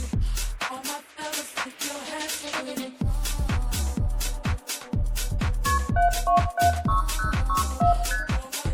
Multi-frequency trunk signalling (R1, as on North American trunks), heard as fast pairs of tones, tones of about 130 ms, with room echo. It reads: KP 7276064 ST